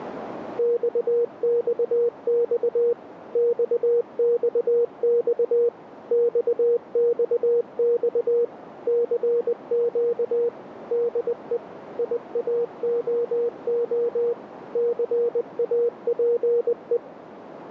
Morse code, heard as a keyed tone, machine-sent, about 20 wpm, 470 Hz, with radio static and a narrow filter. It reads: XXX XXX XXX CQ DE IAOO CAPE